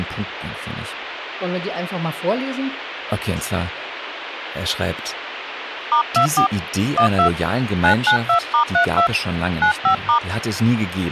DTMF, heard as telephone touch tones, dialled by hand, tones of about 100 ms, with radio hiss and speech in German. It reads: *24 12 992*32 95*